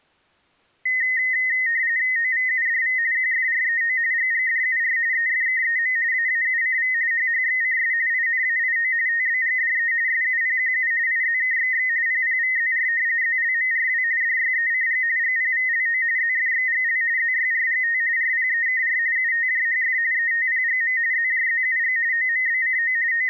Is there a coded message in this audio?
Yes: RTTY (45.45 baud, 170 Hz shift) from 0.9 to 23.3 s, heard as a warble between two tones, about 1950 Hz centre. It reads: OVUDV QFREO GGDUR EFKEM AAUCV HHXCS INAIO TBGDE SUPQU IZKXX PPVZR ZLMRW DYECG GPVLO ZFXGL ZYRGT RPEKR UTJHF ETPGM ZJZUG OMBCO …